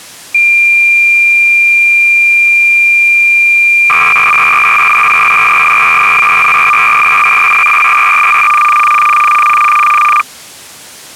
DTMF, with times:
none

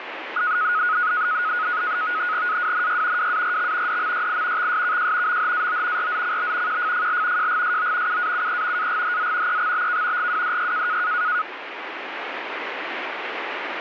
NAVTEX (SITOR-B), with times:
2.5-3.3 AWNY
3.2-4.0 WARX
3.9-4.7 DMYI
4.6-5.4 XSKJ
5.3-6.1 MHAO
6.0-6.8 RZCB
6.7-7.5 QFFL
7.4-8.2 JGSO
8.1-8.9 UAUE
8.8-9.6 AGHZ
9.5-10.3 EXBK
10.2-11.0 GWDY

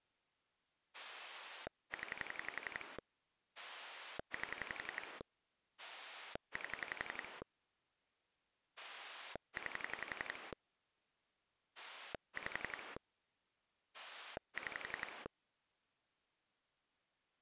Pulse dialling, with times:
0.9-3.0 0
3.6-5.2 8
5.8-7.4 8
8.8-10.5 9
11.8-13.0 5
13.9-15.3 6

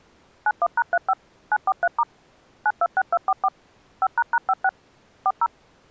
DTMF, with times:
0.5-1.1 91#35
1.5-2.0 943*
2.7-3.5 926244
4.0-4.7 5##56
5.3-5.5 40

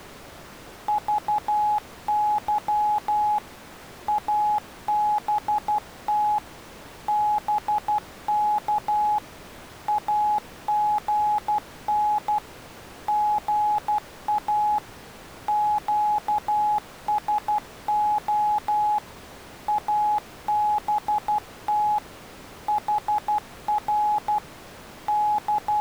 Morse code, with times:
0.9-3.4 VY
4.1-6.4 ABT
7.1-9.2 BK
9.9-12.4 AGN
13.1-14.8 GA
15.5-19.0 QSO
19.7-22.0 ABT
22.7-24.4 HR
25.1-25.8 …

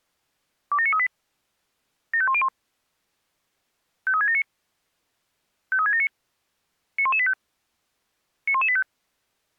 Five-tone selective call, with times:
0.7-1.1 27938
2.1-2.5 75101
4.1-4.4 53679
5.7-6.1 53679
7.0-7.3 91185
8.5-8.8 91185

